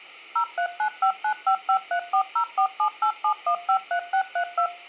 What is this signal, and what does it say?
DTMF, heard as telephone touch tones, dialled by machine, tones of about 90 ms. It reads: 03959553404787153632